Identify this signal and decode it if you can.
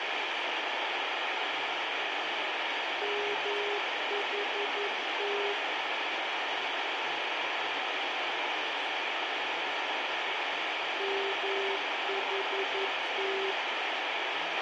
Morse code, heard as a keyed tone, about 11 wpm, 400 Hz, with radio hiss and a squelch burst at the end. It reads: MHT MHT